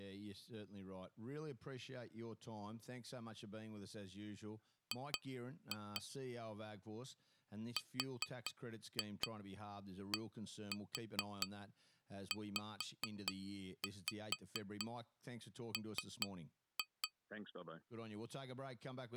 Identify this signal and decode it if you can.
Tap code, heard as taps on glass, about 4 knocks a second, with speech in English. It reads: G RDZM